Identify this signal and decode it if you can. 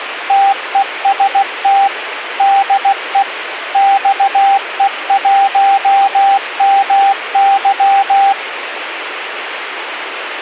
Morse code, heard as a keyed tone, machine-sent, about 16 wpm, 790 Hz, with radio hiss. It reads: TEST DE XE1MY